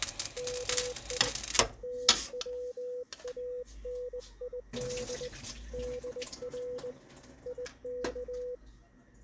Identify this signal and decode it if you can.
Morse code (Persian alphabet), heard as a keyed tone, hand-sent with a straight key, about 20 wpm, 500 Hz, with kitchen noise. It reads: می توانید در یک